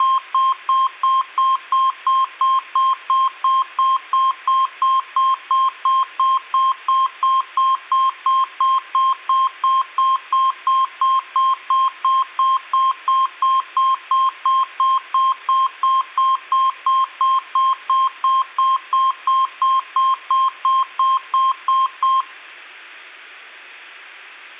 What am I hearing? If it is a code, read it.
Evenly repeated beeps, with room echo. There is no code.